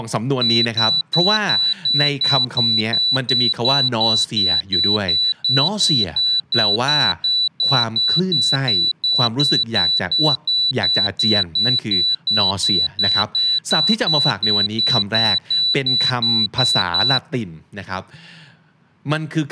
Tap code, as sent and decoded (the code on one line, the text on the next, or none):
none